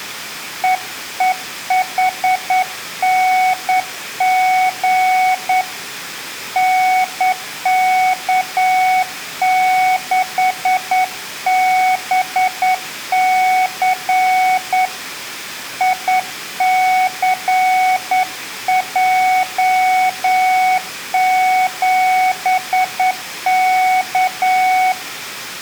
Morse code, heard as a keyed tone, hand-sent with a straight key, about 9 wpm, 740 Hz, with room echo. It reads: EEHNG NK6BC ICJ7K